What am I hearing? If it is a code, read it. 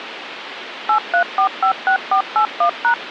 DTMF, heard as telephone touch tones, dialled by machine, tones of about 90 ms, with phone line noise. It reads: 83456481#